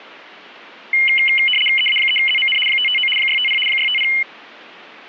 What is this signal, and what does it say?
RTTY (75 baud, 850 Hz shift), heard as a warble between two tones, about 2550 Hz centre. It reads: EA3ZMN 559 650 650